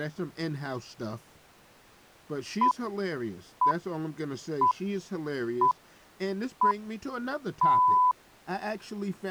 Radio time signal (six pips, as the Greenwich Time Signal), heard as pips, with speech in English.